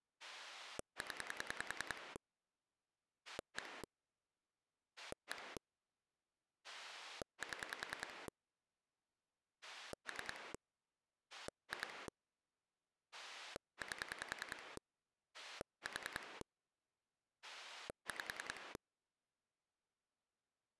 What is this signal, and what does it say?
Pulse dialling, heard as a rotary dial, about 10 pulses a second. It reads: 0 1 1 7 3 2 8 4 5